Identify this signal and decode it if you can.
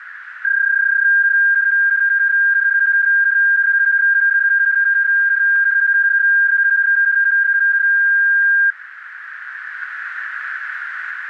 PSK31 (31.25 baud), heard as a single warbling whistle, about 1600 Hz, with radio static and a narrow filter.